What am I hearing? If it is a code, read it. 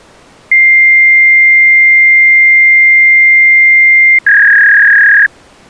Fax machine handshake, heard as a long tone and a warble.